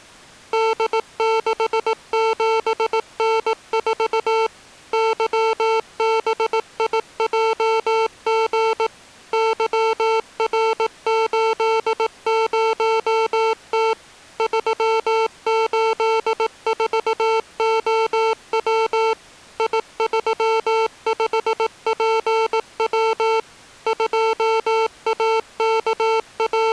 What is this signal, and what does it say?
Morse code, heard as electronic beeps, machine-sent, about 18 wpm, 450 Hz. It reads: D67N4 YBIJG YR80T 384OW I35PW …